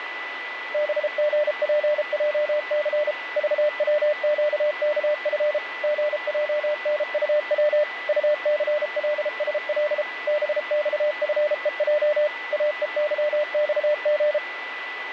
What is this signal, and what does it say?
Morse code, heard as a keyed tone, machine-sent, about 33 wpm, 600 Hz, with radio static and a steady whistle near 1990 Hz. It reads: BGPJC VWQKF GJNUW UCLSL BXFEJ AEYXG